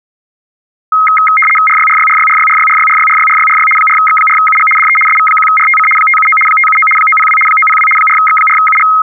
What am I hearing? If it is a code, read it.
RTTY (75 baud, 850 Hz shift), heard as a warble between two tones, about 1700 Hz centre. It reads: RYRYRYRYRYRYRYRYRYRY 4X4UG DE SV1RTC 579 579 902 902 4X4UG